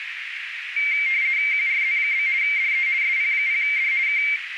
RTTY (50 baud, 170 Hz shift), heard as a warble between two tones, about 2200 Hz centre, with radio static and a narrow filter. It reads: QRZ? DE SP0D K